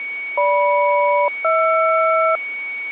Aircraft SELCAL, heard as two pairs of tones, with a steady whistle near 2240 Hz. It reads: GM-HR